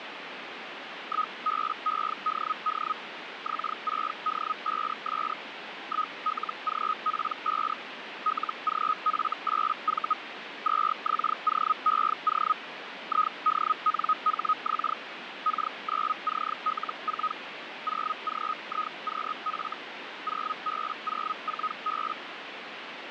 Hellschreiber (Feld-Hell, 122.5 baud), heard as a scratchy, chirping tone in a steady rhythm, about 1260 Hz, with radio static. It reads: 1BEDD X6D5S 1LGP5 LGF8V 2XOEO IDNHX K9CL4 0GIQF 0B04B